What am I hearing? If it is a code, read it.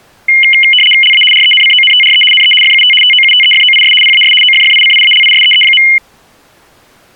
RTTY (75 baud, 850 Hz shift), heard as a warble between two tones, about 2550 Hz centre. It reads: LA RENCONTRE NE FUT TOUTEFOIS PAS OFFICIALISEE.